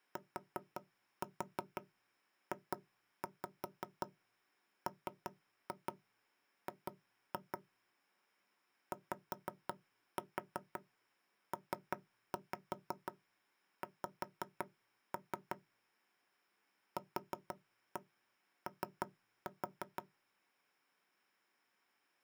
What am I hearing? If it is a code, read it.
Tap code, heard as knocks on wood, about 5 knocks a second. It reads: TJMG YPX QO